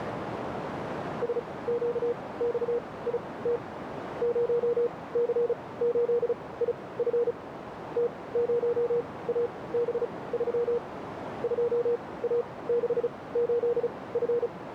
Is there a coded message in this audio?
Yes: Morse code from 1.2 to 14.5 s, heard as a keyed tone, machine-sent, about 35 wpm, spaced as for 21 wpm, 480 Hz, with radio static and a narrow filter. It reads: SQXIT 0C8IF T0AB3 2A68F